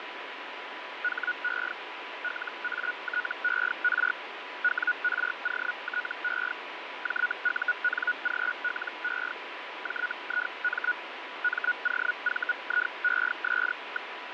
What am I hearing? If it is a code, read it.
Hellschreiber (Feld-Hell, 122.5 baud), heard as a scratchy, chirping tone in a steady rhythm, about 1460 Hz, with radio static and fading. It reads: HE LATER WROTE JUNGLE JIM MOVIES.